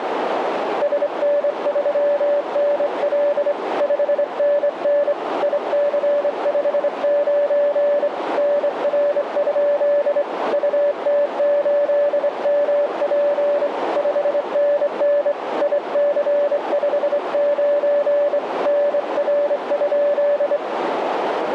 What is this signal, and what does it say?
Morse code, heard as a keyed tone, hand-sent with a straight key, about 25 wpm, 580 Hz, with radio static and a narrow filter. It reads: SN3NL 5NN IC59 NR? UT8MP 5NN IC59 NR?